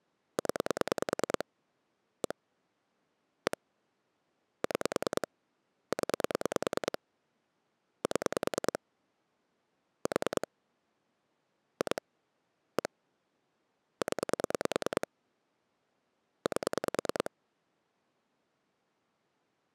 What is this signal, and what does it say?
Pulse dialling, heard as clicks on a phone line, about 9 pulses a second. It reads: 0 1 1 6 0 7 4 2 1 0 8